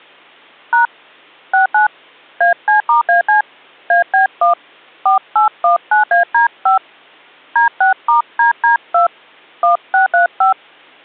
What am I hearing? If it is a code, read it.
DTMF, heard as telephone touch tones, dialled by hand, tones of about 120 ms. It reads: # 69 AC*AC AB1 4819AD5 D6*DD2 1635